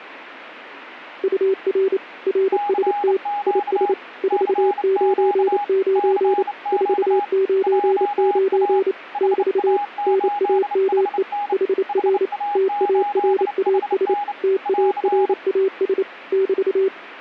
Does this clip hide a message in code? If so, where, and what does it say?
Yes: Morse code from 1.2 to 16.9 s, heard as two keyed tones. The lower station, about 28 wpm, 380 Hz: UR RST IS 499 499 <BT> NAME HR TARAS TARAS <BT>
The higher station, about 29 wpm, 820 Hz: CQ CQ CQ JA HA8HN HA8HN <AR>